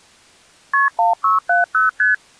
Multi-frequency trunk signalling (R1, as on North American trunks), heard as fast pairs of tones, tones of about 150 ms. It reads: KP 1670 ST